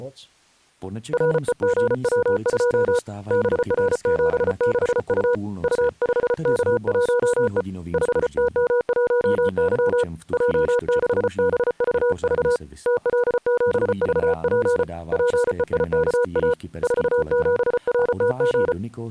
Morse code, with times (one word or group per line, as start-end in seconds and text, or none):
1.1-3.0 REGW2
3.3-5.3 BR76U
5.6-7.6 U5K1E
7.9-10.0 5TM1Y
10.3-12.6 J6BVV
12.9-14.8 TL7VP
15.1-16.5 PEIKA
16.8-18.7 47RTG